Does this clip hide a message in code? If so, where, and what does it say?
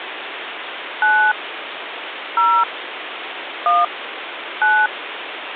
Yes: DTMF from 1.0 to 4.9 s, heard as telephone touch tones, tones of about 230 ms, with phone line noise. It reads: 9 0 1 9